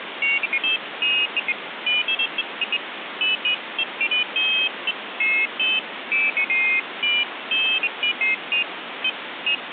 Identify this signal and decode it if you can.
Pairs of high tones at irregular times, with phone line noise. There is no code.